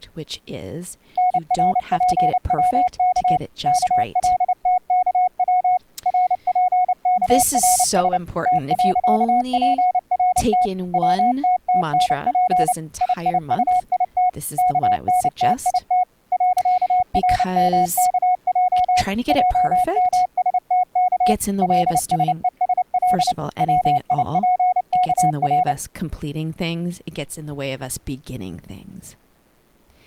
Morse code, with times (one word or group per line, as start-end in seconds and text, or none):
1.2-3.4 NRPWK
3.7-5.8 KLTKW
6.1-8.2 RPKRS
8.5-10.7 T.PRT
10.9-12.7 WTTNP
13.0-14.3 IIUIT
14.6-16.0 KNTIT
16.3-19.0 .RMKJ
19.3-21.3 JMSTK
21.6-23.3 LSESL
23.6-25.7 WIPKR